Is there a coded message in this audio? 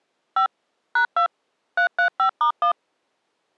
Yes: DTMF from 0.4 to 2.7 s, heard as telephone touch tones, dialled by machine, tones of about 100 ms. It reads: 5 #2 335*1